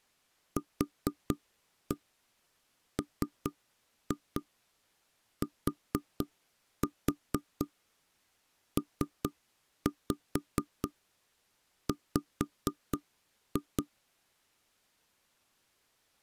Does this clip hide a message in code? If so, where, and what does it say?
Yes: tap code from 0.6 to 13.9 s, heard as knocks on wood, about 4 knocks a second. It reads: QMTPW